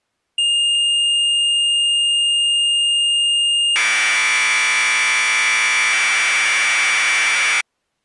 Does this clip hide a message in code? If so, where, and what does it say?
Yes: Commodore tape loading (standard loader) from 0.4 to 7.6 s, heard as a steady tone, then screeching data.